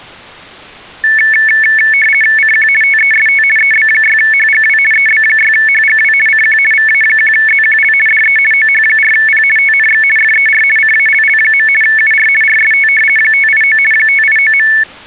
RTTY (50 baud, 450 Hz shift), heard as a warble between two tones, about 2000 Hz centre. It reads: CQ TEST EB6HGW EB6HGW CQ VA1ZQL DE OH4P TNX FER CALL. UR RST 589 589.